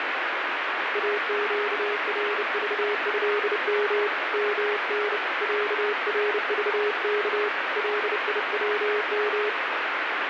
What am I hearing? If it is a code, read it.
Morse code (Arabic alphabet), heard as a keyed tone, hand-sent with a bug key, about 30 wpm, 420 Hz, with heavy radio static. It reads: اقرضهم من عرضك ليوم